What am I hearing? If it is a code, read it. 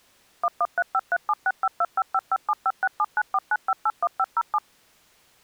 DTMF, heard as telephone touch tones, dialled by machine, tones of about 50 ms. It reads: 1135376525557567949581507